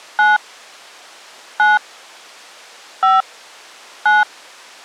DTMF, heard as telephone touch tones, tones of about 180 ms. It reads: 9 9 5 9